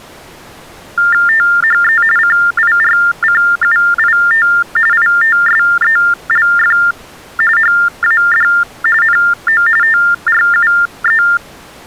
TTY/TDD text telephone tones (45.45 baud Baudot), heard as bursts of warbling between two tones, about 400 Hz shift, 1600 Hz centre. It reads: THE CIRCUIT ITSELF HAD NO TRUE